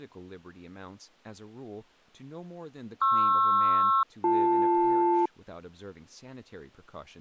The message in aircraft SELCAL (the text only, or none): PR-BL